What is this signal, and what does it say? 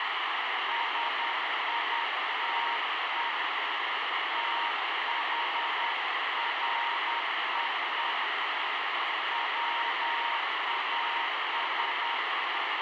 Morse code, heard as a keyed tone, hand-sent with a paddle, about 10 wpm, 940 Hz, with heavy radio static. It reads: SITE THREE WAS